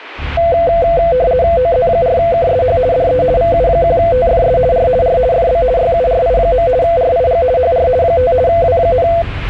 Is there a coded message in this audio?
Yes: RTTY (50 baud, 170 Hz shift) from 0.4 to 9.2 s, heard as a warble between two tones, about 590 Hz centre, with the noise inside a bus. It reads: OZ4KSH DE VU1TFS R R FB YURI. RIG HR 5 W,